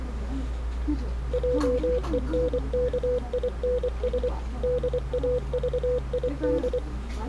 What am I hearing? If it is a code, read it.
Morse code, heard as a keyed tone, machine-sent, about 24 wpm, 500 Hz, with the noise of a crowd indoors. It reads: JENKINS DAVID